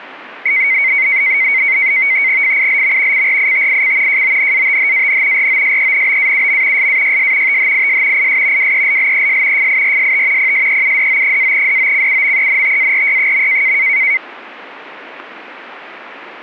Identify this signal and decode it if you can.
NAVTEX (SITOR-B), 100 baud, 170 Hz shift, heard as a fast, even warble, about 2150 Hz centre. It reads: FILM CRITIC JONATHAN ROSENBAUM SAYS THIS IS WELLES FIRST PSEUDO-DOCUMENTARY.